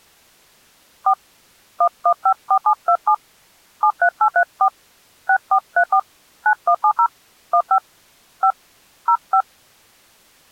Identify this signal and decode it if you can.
DTMF, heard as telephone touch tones, dialled by hand, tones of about 70 ms. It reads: 4 1154727 73834 6434 9170 15 5 05